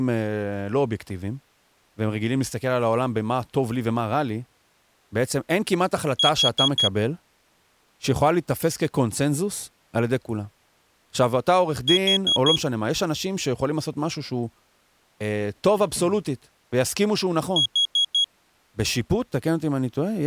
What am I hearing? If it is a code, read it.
Alarm pattern, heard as an alarm's beeps, played three times, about 3300 Hz, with speech in Hebrew. Temporal four. Carbon monoxide.